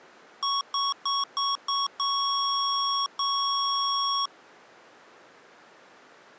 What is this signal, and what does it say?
Beep code, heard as beeps from a small speaker, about 1110 Hz. 5 short, 2 long.